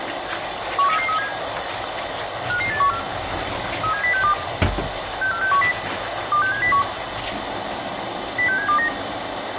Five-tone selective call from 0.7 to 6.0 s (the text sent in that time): 13337 55814 37062 64610